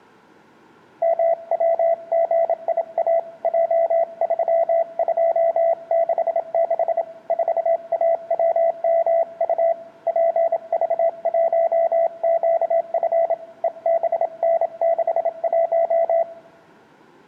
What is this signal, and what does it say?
Morse code, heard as a keyed tone, hand-sent with a bug key, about 27 wpm, 670 Hz, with room echo. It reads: MWGIA J3266 4AWMU PV1QF EBN61